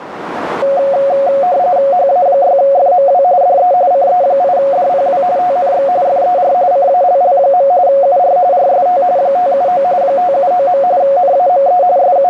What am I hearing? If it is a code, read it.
RTTY (45.45 baud, 170 Hz shift), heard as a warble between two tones, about 640 Hz centre, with radio static and a narrow filter. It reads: HA6FMW DE CE8DPW TNX FER CALL. UR RST 579 579. NAME …